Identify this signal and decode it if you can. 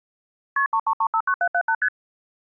Multi-frequency trunk signalling (R1, as on North American trunks), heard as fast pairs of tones, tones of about 70 ms. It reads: KP 33359778 ST